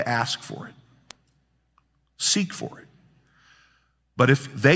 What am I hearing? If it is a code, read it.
Speech in English. There is no code.